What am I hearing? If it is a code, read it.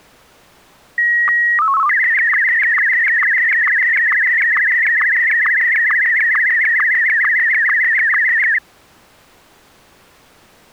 SSTV (slow-scan television), Martin M1, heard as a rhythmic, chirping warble.